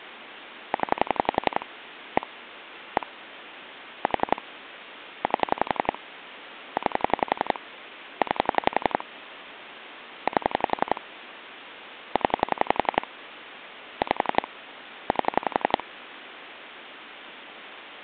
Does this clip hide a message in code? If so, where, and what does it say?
Yes: pulse dialling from 0.7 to 15.8 s, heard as clicks on a phone line, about 11 pulses a second, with phone line noise. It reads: 0 1 1 4 8 9 9 8 0 5 8